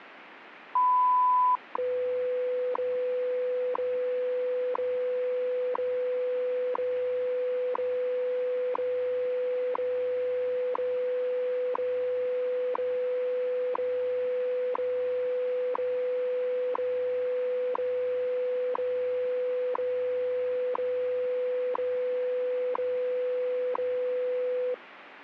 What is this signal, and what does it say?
Radio time signal (WWV, Colorado), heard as ticks, one a second, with radio static.